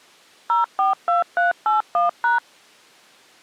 DTMF, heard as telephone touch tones, dialled by machine, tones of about 140 ms. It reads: 042381#